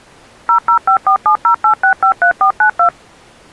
DTMF, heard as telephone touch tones, dialled by machine, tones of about 100 ms. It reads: 0054708653492